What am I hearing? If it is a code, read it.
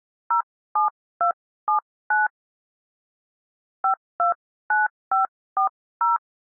DTMF, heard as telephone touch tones, dialled by hand, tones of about 130 ms. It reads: 07279 529540